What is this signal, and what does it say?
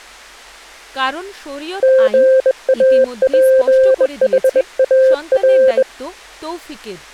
Morse code, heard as a keyed tone, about 21 wpm, 520 Hz, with speech in Bangla. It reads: GAPHAR